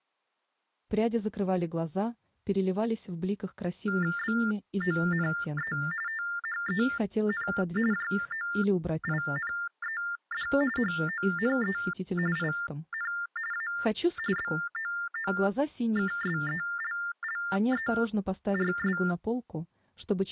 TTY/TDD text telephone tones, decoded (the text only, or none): BONE THEN JOINED HONE IN A BOOKSELLERS